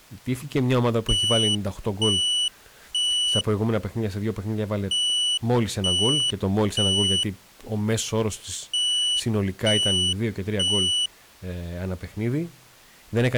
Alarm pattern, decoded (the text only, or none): temporal three